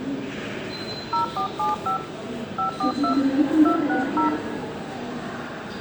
DTMF, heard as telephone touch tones, dialled by hand, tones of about 120 ms, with the noise of a subway station. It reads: 0475 542 260